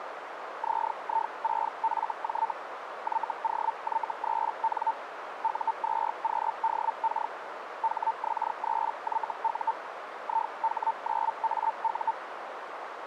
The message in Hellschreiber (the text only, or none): ZI6FJ YOY3N U2QDK HX3YU IH9AU